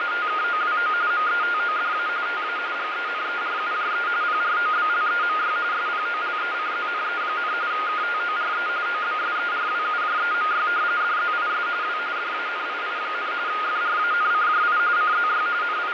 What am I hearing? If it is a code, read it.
RTTY (45.45 baud, 170 Hz shift), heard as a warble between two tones, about 1330 Hz centre, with radio static and fading. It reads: … METODA TA GENERUJE PROBLEMY SPOLECZNE, KTORE OBSERWUJEMY DZIS W DANII, FRANCJI CZY …